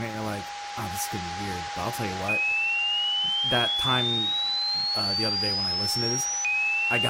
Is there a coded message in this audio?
No, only a tone that sweeps in pitch again and again, with radio static, a steady whistle near 820 Hz and speech in English.